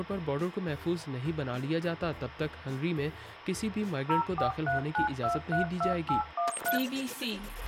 DTMF, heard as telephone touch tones, dialled by machine, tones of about 120 ms, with radio hiss and a squelch burst at the end. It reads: 0439232813